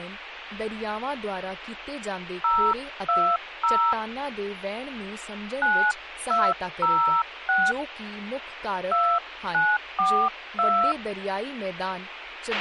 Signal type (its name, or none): DTMF